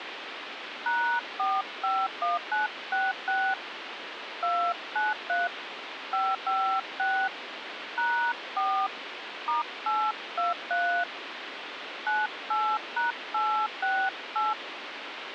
DTMF, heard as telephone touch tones, dialled by hand, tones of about 240 ms, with phone line noise. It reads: #451966 293 556 #4 *823 98#868